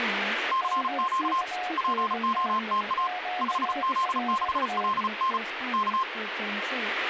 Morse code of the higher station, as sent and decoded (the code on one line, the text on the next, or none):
-.-. --.- / .--. --- - .- / ..... --.. -.... .-.. -. / -.-
CQ POTA 5Z6LN K